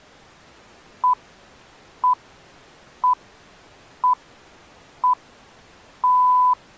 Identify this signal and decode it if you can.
Radio time signal (six pips, as the Greenwich Time Signal), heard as pips.